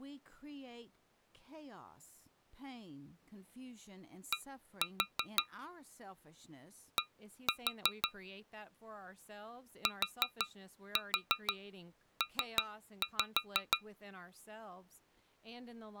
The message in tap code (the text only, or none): D D TP